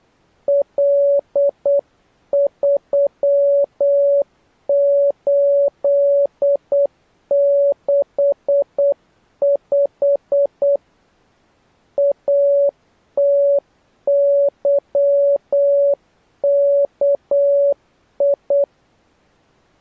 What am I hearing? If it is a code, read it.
Morse code, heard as a keyed tone, hand-sent with a paddle, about 8 wpm, 560 Hz. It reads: L3865 ATYKI